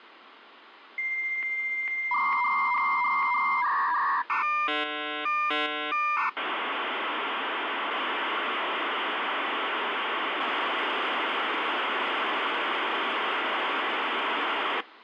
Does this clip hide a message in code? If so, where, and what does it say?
Yes: dial-up modem handshake (V.34 or later) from 1.0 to 14.8 s, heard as a whistle, warbles, then hiss, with phone line noise.